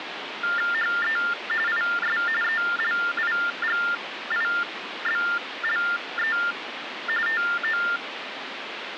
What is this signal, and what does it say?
TTY/TDD text telephone tones (45.45 baud Baudot), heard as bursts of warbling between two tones, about 400 Hz shift, 1600 Hz centre, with phone line noise. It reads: HE IS ELIGIBLE TO